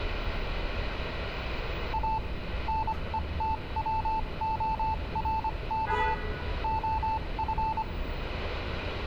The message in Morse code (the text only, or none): A NETWORK OF